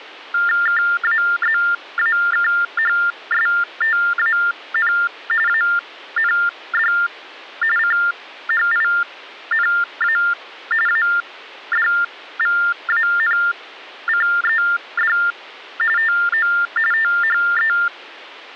TTY/TDD text telephone tones (45.45 baud Baudot), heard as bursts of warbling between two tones, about 400 Hz shift, 1600 Hz centre. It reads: KAZAKHSTAN AND CHINA ADVANCED TO THE